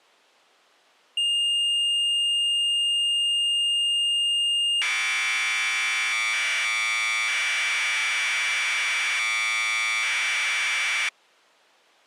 Commodore tape loading (standard loader), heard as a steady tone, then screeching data.